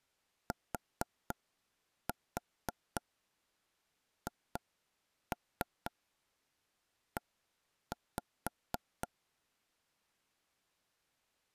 Tap code, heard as knocks on wood, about 4 knocks a second. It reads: THE